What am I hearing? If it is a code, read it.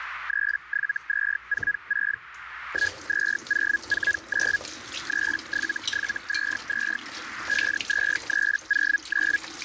Hellschreiber (Feld-Hell, 122.5 baud), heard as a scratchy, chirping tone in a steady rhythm, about 1650 Hz, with radio static, a narrow filter and kitchen noise. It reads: 37246 12049 37722 52309